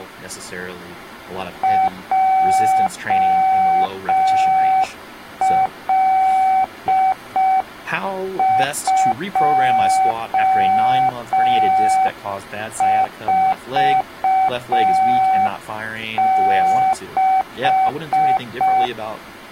Morse code, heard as a keyed tone, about 5 wpm, 760 Hz, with speech in English. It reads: JL246